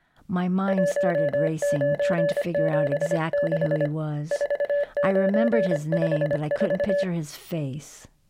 Morse code, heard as a keyed tone, hand-sent with a paddle, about 25 wpm, 580 Hz, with speech in English. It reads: 1976 4954